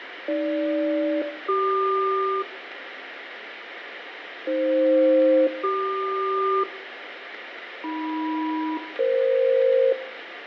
Aircraft SELCAL, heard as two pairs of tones, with radio static, fading and room echo. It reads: AG-CQ AF-CQ AM-EF